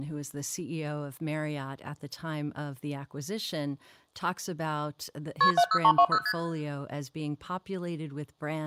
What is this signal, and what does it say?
Multi-frequency trunk signalling (R1, as on North American trunks), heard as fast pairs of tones, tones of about 70 ms, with speech in English. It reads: KP 70320 ST